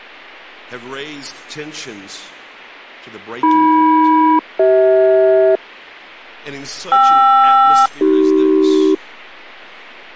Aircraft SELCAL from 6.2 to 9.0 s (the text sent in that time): KR-AC